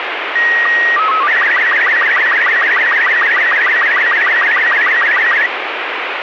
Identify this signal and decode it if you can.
SSTV (slow-scan television), Robot 36, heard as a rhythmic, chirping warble, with radio static.